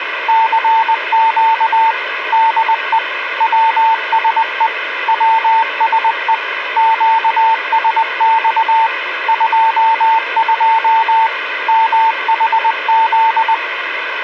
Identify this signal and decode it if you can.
Morse code, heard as a keyed tone, machine-sent, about 20 wpm, 900 Hz, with radio hiss. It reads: CQ DE WSE WSE QSX 22 MHZ